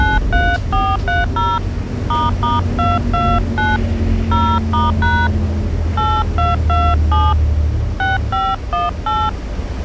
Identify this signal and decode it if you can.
DTMF, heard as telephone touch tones, dialled by hand, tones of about 220 ms, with the noise inside a bus. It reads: 93430 **229 0*# 8227 6518